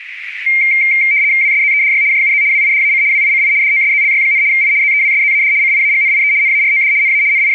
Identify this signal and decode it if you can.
RTTY (75 baud, 170 Hz shift), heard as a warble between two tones, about 2200 Hz centre, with radio static. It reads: WSZEDY JUZ WIDAC WICI DOSZLY, I ZEWSZAD CIAGNIE NAROD NA …